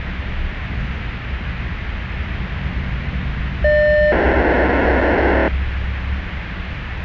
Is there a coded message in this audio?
Yes: POCSAG pager data (1200 baud) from 3.6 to 5.5 s, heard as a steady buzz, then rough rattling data, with radio hiss and the noise inside a bus.